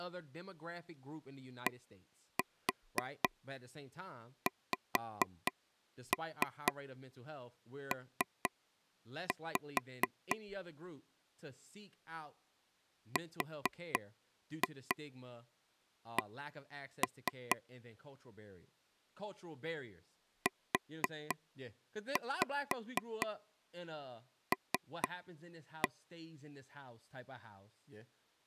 Tap code, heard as taps on a table, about 4 knocks a second, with speech in English. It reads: DXP RC UL